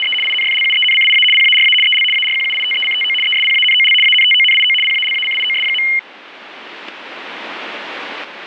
RTTY (75 baud, 850 Hz shift), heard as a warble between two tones, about 2550 Hz centre. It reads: … INFLUENCIA PARA EL ARQUITECTO ESPANOL ANTONIO PALACIOS.